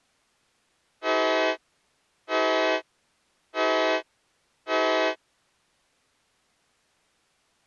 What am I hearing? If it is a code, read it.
Train horn signal, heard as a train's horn. 4 short. On North American railways: a request for a signal to be given or repeated.